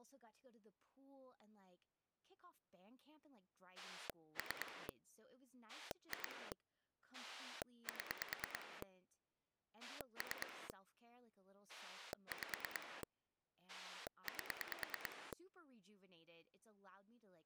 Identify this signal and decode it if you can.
Pulse dialling, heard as a rotary dial, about 9 pulses a second, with speech in English. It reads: 3 2 7 3 5 8